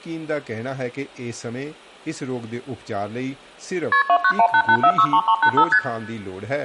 Multi-frequency trunk signalling (R1, as on North American trunks), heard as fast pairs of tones, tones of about 70 ms, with room echo and speech in Hindi. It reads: KP 29188463385 ST